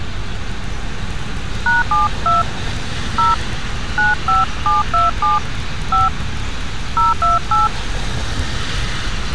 DTMF, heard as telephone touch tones, dialled by hand, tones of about 160 ms, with street noise. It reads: #72 0 95727 5 028